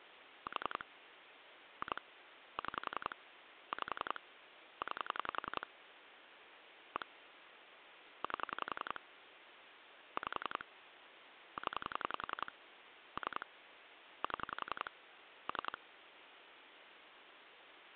Pulse dialling, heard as clicks on a phone line, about 11 pulses a second, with phone line noise. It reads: 4 2 6 5 9 1 8 5 0 3 7 3